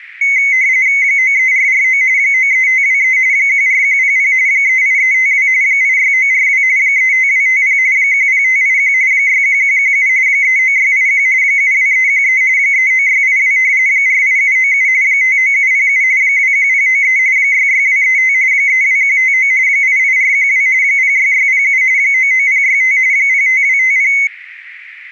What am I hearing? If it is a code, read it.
RTTY (45.45 baud, 170 Hz shift), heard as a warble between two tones, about 2150 Hz centre, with radio static. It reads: 93449 93523 14100 38352 86942 35250 10581 61117 39681 72313 39682 48797 59707 21093 66235 32159 88412 06607 99065 05250